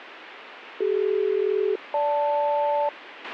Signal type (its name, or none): aircraft SELCAL